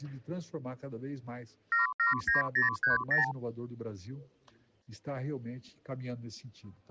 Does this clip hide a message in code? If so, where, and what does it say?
Yes: multi-frequency trunk signalling (R2, with the far end's replies) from 1.7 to 3.3 s, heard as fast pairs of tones, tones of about 140 ms. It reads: 779030